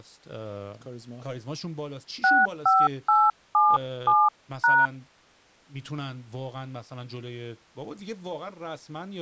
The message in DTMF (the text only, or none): 65877#